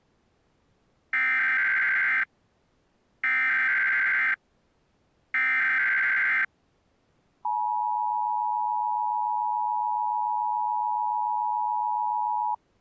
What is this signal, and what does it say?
Emergency Alert System (SAME) tones (header bursts, then the 853 and 960 Hz attention tone), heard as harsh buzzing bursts, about 520.83 baud.